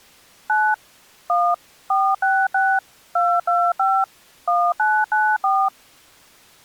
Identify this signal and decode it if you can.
DTMF, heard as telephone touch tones, dialled by machine, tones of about 250 ms. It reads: 9 1 466 225 1994